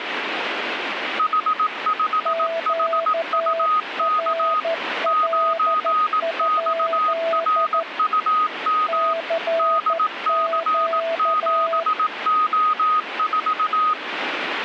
Morse code, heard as two keyed tones, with radio static. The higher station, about 18 wpm, 1250 Hz: H5HUK 9XRUM DC7O4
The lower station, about 13 wpm, 660 Hz: QRL? CQ